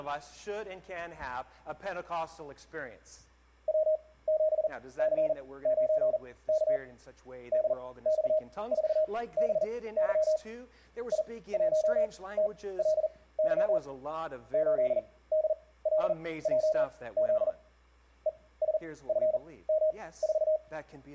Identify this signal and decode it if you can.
Morse code, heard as a keyed tone, machine-sent, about 40 wpm, spaced as for 20 wpm, 620 Hz. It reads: W7C9K DX4BY I1TLY 8DLJZ ESFM4